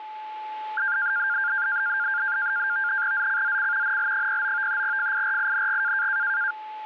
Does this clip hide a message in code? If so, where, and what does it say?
Yes: NAVTEX (SITOR-B), 100 baud, 170 Hz shift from 0.8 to 6.5 s, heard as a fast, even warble, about 1500 Hz centre, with a steady whistle near 860 Hz. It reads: ZCZC NL09 FIRING